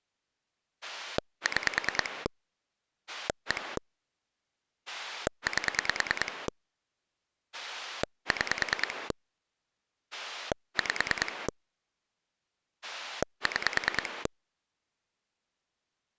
Pulse dialling, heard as a rotary dial, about 9 pulses a second. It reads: 6 1 8 6 5 6